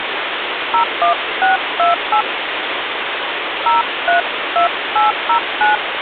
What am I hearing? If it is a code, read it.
DTMF, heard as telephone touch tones, dialled by hand, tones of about 110 ms, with phone line noise. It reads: 01628 032809